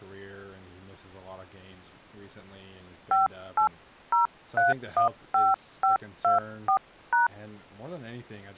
DTMF, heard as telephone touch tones, dialled by hand, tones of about 140 ms, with speech in English. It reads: 580315524#